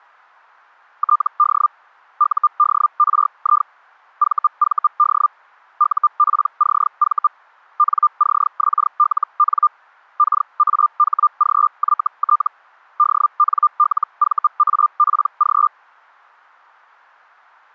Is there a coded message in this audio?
Yes: Hellschreiber (Feld-Hell, 122.5 baud) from 1.0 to 15.7 s, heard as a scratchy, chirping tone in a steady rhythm, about 1200 Hz. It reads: TD UDRI VVD UPCV NCXLN KAHGYT DNLVAPG